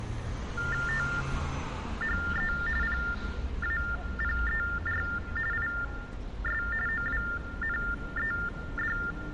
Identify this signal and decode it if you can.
TTY/TDD text telephone tones (45.45 baud Baudot), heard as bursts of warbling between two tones, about 400 Hz shift, 1600 Hz centre, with room echo and street noise. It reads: THE PAPER IS OWNED